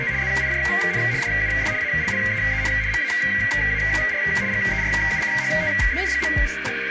RTTY (75 baud, 170 Hz shift), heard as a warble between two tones, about 2050 Hz centre, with radio static and a narrow filter. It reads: … ZIJN DUS ALLEEN MAAR GERUCHTEN.